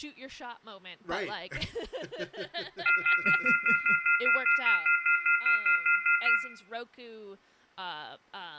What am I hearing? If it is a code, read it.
Telephone call progress tone (North American plan), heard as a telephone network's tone, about 1400, 2050, 2450, 2600 Hz, 0.1 s on and 0.1 s off, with room echo and speech in English. Off-hook warning tone.